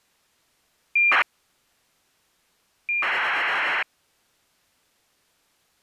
ACARS aircraft data, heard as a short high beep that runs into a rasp, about 2400 baud.